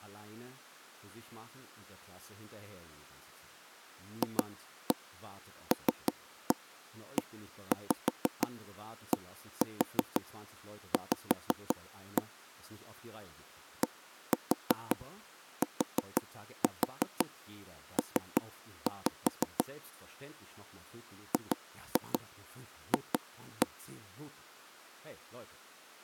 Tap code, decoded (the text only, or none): FLEDV DTP GF